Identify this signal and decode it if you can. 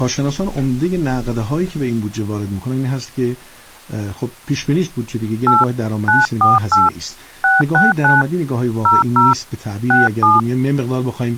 DTMF, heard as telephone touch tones, dialled by hand, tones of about 170 ms. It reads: 8 948 669 00 67